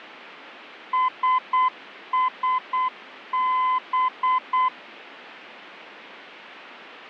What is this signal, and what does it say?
Morse code, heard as a keyed tone, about 8 wpm, 1020 Hz. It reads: SSB